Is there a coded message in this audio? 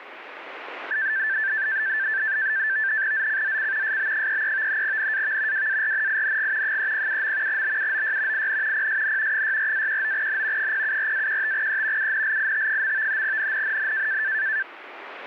Yes: NAVTEX (SITOR-B), 100 baud, 170 Hz shift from 0.9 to 14.6 s, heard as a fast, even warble, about 1650 Hz centre, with radio static. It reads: ZCZC SB33 NAV WARNING 307. BUOY IN PSN 64-19N 074-15E UNLIT. NNNN